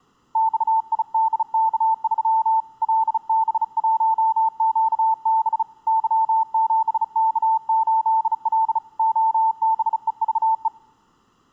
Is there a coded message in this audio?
Yes: Morse code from 0.3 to 10.7 s, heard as a keyed tone, hand-sent with a bug key, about 35 wpm, 890 Hz. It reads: XIDK3 LB1QB Y7K8L OBEVE